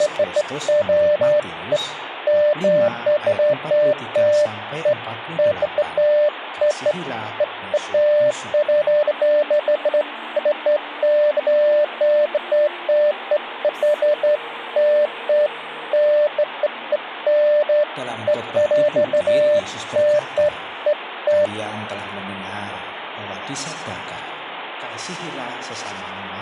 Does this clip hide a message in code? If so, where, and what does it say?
No, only beeps of irregular length, with phone line noise.